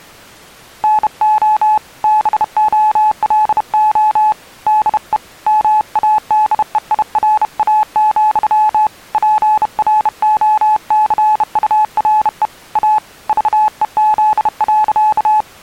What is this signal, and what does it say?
Morse code, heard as a keyed tone, hand-sent with a bug key, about 31 wpm, 860 Hz. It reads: NO BOLO DE MADEIRA, PROCURE A VEZ.